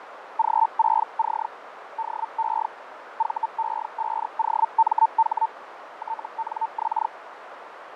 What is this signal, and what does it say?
Hellschreiber (Feld-Hell, 122.5 baud), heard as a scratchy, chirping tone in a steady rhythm, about 900 Hz, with radio static, fading and a narrow filter. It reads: G6C DE VE5OMH TNX